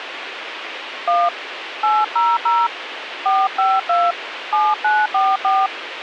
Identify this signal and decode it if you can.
DTMF, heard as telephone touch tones, dialled by hand, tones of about 220 ms, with radio hiss. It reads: 1 800 452 7944